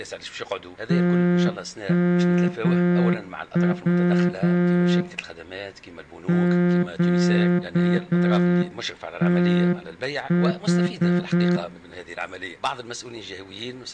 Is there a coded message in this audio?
Yes: Morse code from 0.8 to 11.6 s, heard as a horn, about 7 wpm, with room echo. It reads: TMW QTH